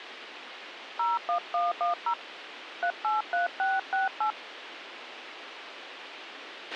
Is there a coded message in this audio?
Yes: DTMF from 1.0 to 4.3 s, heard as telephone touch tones, dialled by hand, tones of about 140 ms, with radio hiss and a squelch burst at the end. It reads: 01110 383668